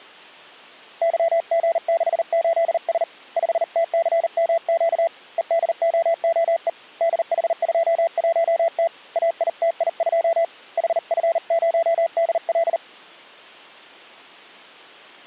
Morse code, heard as a keyed tone, hand-sent with a paddle, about 39 wpm, 670 Hz. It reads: YG68S 5TCMQ EDOOE DH21T AITI2 HF0DL